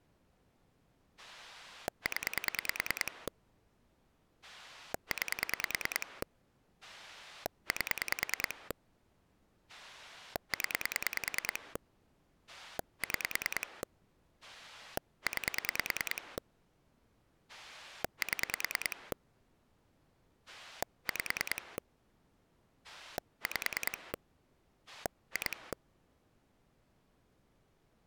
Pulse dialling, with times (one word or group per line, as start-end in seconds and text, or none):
1.2-3.3 0
4.4-6.2 9
6.8-8.7 8
9.7-11.8 0
12.5-13.8 6
14.4-16.4 9
17.5-19.1 7
20.5-21.8 5
22.8-24.1 5
24.9-25.7 2